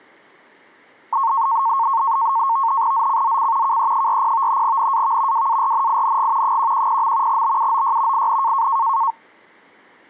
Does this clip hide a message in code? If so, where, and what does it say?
Yes: NAVTEX (SITOR-B), 100 baud, 170 Hz shift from 1.1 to 9.1 s, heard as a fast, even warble, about 1000 Hz centre. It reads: ZCZC KE40 NAV WARNING 110. BUOY IN